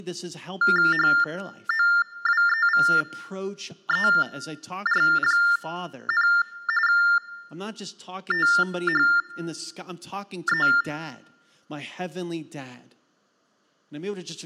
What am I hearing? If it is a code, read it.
TTY/TDD text telephone tones (45.45 baud Baudot), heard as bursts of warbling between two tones, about 400 Hz shift, 1600 Hz centre, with speech in English. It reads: HOWEVER, THE